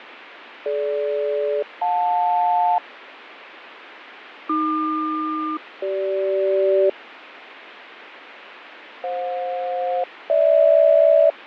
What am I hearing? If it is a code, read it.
Aircraft SELCAL, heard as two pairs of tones, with radio static and fading. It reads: DG-JL AQ-CG FJ-GH